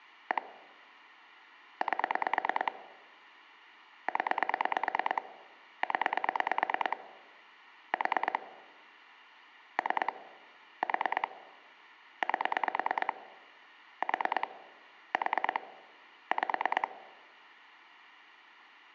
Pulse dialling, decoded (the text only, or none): 1 8 0 0 4 3 4 8 4 4 5